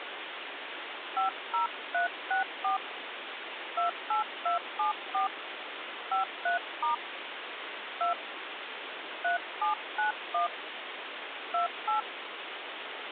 DTMF, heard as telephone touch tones, dialled by hand, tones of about 130 ms, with phone line noise. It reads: 50364 28274 53* 2 3791 28